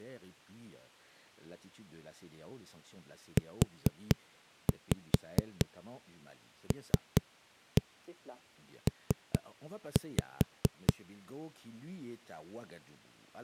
Tap code, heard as knocks on a wall, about 4 knocks a second, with speech in French. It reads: ULP